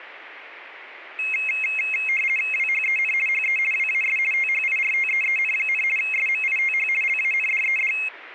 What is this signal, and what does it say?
RTTY (50 baud, 450 Hz shift), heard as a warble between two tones, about 2350 Hz centre. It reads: WHEN HE WAS THIRTEEN, SMITH LANDED